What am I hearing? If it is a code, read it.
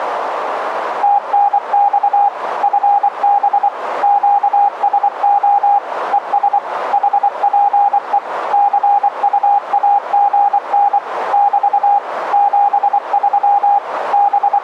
Morse code, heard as a keyed tone, machine-sent, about 24 wpm, 810 Hz, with radio static and a narrow filter. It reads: TNX FB QSO ES HPE CUAGN <BT> 73 …